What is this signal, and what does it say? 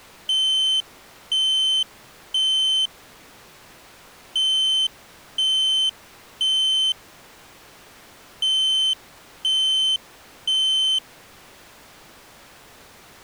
Alarm pattern, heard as an alarm's beeps, played three times, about 3100 Hz. Temporal three. Smoke or fire, evacuate.